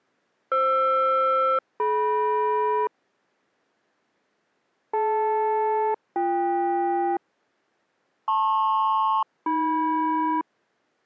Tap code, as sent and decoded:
none

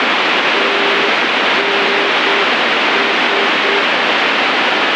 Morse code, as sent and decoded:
- -. ...
TNS

